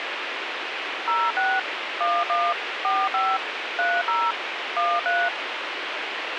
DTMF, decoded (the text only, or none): 06 11 45 30 13